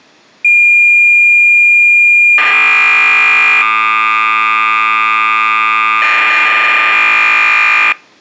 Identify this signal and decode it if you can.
Cassette data (Kansas City type), 1200 baud, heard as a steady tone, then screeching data.